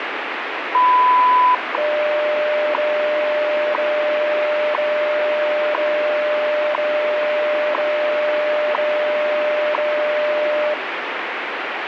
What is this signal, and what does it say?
Radio time signal (WWV, Colorado), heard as ticks, one a second, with radio static.